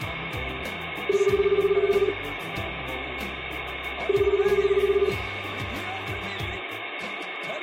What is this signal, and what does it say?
Telephone call progress tone (Japanese plan), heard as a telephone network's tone, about 380, 400, 420 Hz, 1 s on and 2 s off, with phone line noise. Ringback tone.